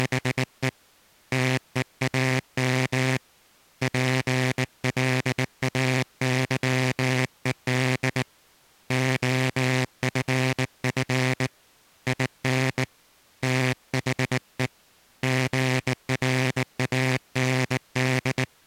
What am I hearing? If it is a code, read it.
Morse code, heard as a buzzer, hand-sent with a bug key, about 19 wpm. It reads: … TEAM PLAYED OFF IN THE GRAND